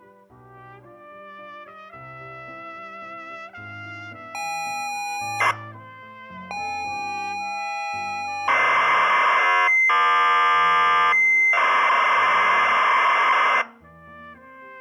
ZX Spectrum tape loading, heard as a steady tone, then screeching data.